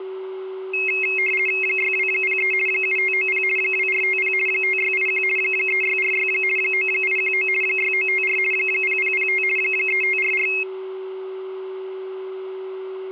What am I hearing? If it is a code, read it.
RTTY (50 baud, 450 Hz shift), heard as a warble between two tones, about 2350 Hz centre, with a steady whistle near 380 Hz. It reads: 6203 7590 2450 5681 3646 9819 6954 0005 3544